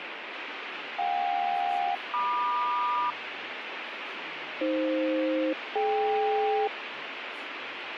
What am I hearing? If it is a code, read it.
Aircraft SELCAL, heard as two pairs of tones, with radio static and speech in English. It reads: JK-MQ AF-DK